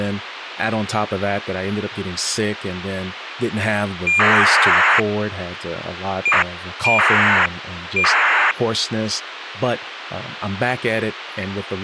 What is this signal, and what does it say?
ACARS aircraft data, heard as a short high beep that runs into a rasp, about 2400 baud, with radio hiss and speech in English.